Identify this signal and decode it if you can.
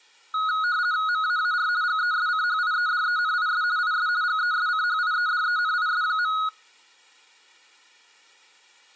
RTTY (50 baud, 170 Hz shift), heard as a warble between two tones, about 1360 Hz centre. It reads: MAAR GESCHIEDENIS IS GESCHIEDENIS.